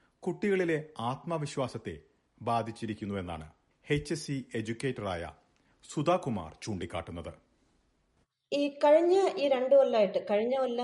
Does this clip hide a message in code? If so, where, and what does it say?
No.